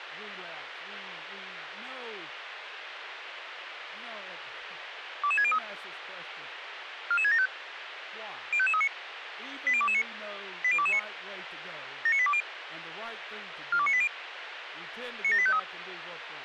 Five-tone selective call (ZVEI), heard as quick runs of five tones, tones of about 70 ms, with radio hiss and speech in English. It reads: 22603 44675 05539 80229 80229 79820 42980 97853